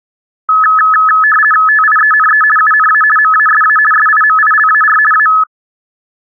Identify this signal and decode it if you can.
RTTY (50 baud, 450 Hz shift), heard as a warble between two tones, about 1500 Hz centre. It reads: TIENE UNA MASA SIMILAR A